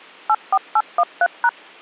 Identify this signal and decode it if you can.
DTMF, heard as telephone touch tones, dialled by machine, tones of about 50 ms. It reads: 84813#